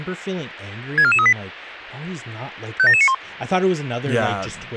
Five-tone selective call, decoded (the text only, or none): 64438 57791